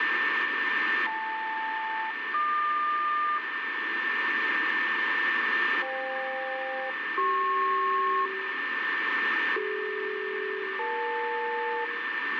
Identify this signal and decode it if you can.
Aircraft SELCAL, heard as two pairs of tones, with radio static, a steady whistle near 1790 Hz and room echo. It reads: JL-HQ FK-CP CD-EL